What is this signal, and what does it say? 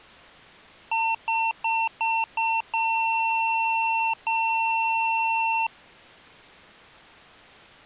Beep code, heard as beeps from a small speaker, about 900 Hz. 5 short, 2 long.